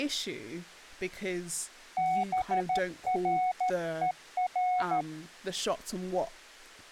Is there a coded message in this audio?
Yes: Morse code (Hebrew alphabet) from 1.9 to 5.1 s, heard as a keyed tone, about 13 wpm, 740 Hz, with speech in English. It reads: ברור